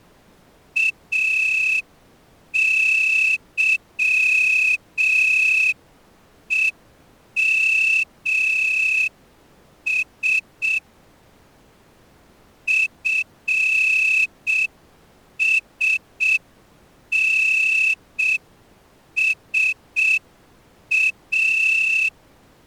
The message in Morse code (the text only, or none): AYEMS FSNSA